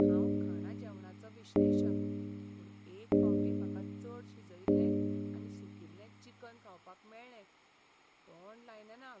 Clock strike, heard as a bell, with speech in Goan Konkani. 4. Four o'clock.